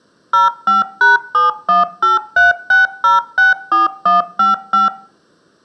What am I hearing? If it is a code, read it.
DTMF, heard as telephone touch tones, dialled by machine, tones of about 150 ms, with room echo. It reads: 05#71836064155